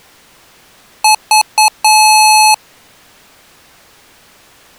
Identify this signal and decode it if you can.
Beep code, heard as beeps from a small speaker, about 860 Hz. 3 short, 1 long.